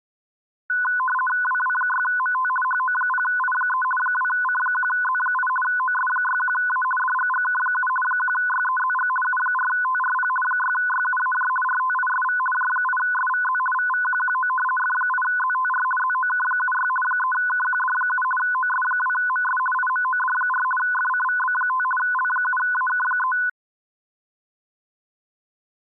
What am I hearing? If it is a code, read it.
RTTY (50 baud, 450 Hz shift), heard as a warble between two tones, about 1250 Hz centre. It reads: WW6MT HO0I3 2C1Z8 OS61A DGGK7 1YEZG U4TRP 6YUAJ RTISV J8SVZ VVQQO F8ZTR ZOK76 3KQD7 OS2MS IMOD4 FCVB5 L7AK3